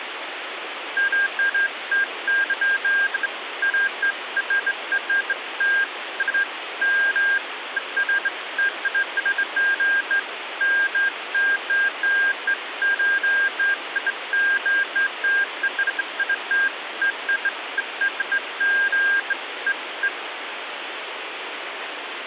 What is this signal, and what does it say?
Beeps of irregular length, with phone line noise. There is no code.